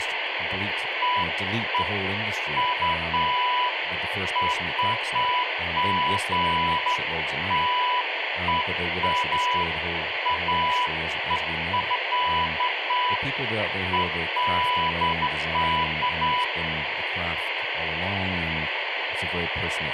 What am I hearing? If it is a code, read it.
Beeps of irregular length, with radio hiss and speech in English. There is no code.